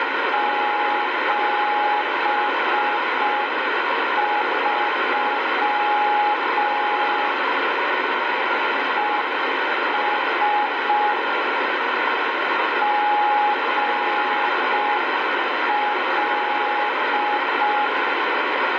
Morse code, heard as a keyed tone, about 5 wpm, 840 Hz, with heavy radio static. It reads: 73 ES GL